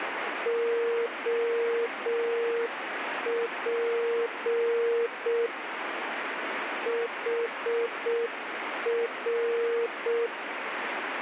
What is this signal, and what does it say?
Morse code, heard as a keyed tone, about 6 wpm, 470 Hz, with radio static. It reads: OP HR